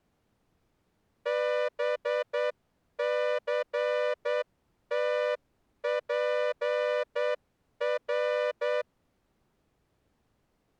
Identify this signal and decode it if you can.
Morse code, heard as a horn, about 9 wpm. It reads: BCTPR